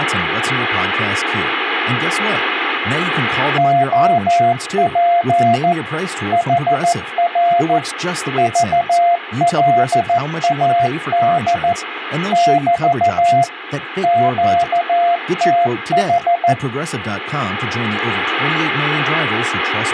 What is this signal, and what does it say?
Morse code, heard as a keyed tone, machine-sent, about 14 wpm, 690 Hz, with radio static and speech in English. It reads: OP HR VLAD <BT> QTH